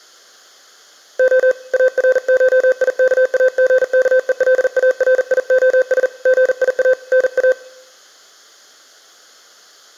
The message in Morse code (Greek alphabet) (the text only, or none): Ο ΑΡΧΙΚΑΓΚΕΛΑΡΙΟΣ ΓΙΑ ΝΑ